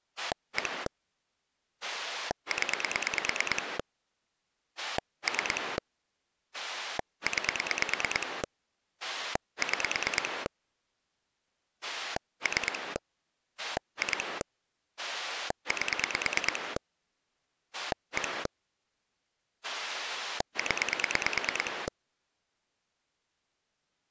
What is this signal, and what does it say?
Pulse dialling, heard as a rotary dial, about 9 pulses a second. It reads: 1 0 3 9 6 3 2 8 1 0